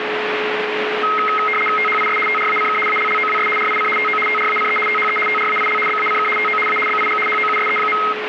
RTTY (75 baud, 850 Hz shift), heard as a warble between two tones, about 1700 Hz centre, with radio static and a steady whistle near 430 Hz. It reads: THIS TRACK ALLOWS RIC TO TRACE THE TRAIL BACK TO A BIG HOUSE.